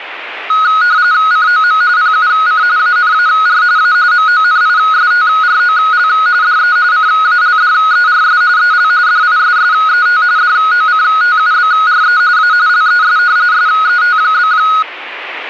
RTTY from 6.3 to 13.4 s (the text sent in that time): DE CALDERS EL DISSET DOCTUBRE A LES